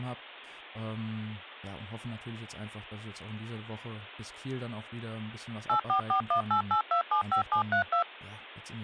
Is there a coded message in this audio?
Yes: DTMF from 5.7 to 8.0 s, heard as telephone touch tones, dialled by machine, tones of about 100 ms, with speech in German. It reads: 844188275732